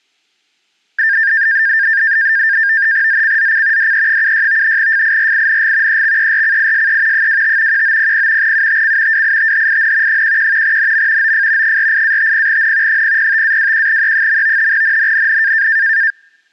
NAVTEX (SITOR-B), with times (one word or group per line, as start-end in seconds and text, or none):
3.1-3.9 ZCZC
3.8-4.8 DE76
4.8-6.0 FIRING
5.9-7.3 EXERCISE
7.1-7.8 25
7.7-8.5 1900
8.4-9.2 UTC
9.1-10.2 WITHIN
10.1-10.8 11
10.6-11.3 NM
11.2-11.8 OF
11.6-13.0 48-50N
12.9-14.7 005-21E.
14.7-15.7 NNNN